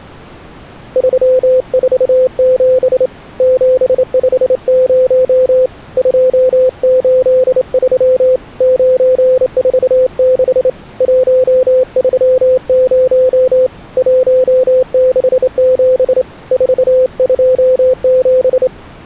Morse code, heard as a keyed tone, hand-sent with a straight key, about 28 wpm, 510 Hz. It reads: 347 750 283 946 130 167 427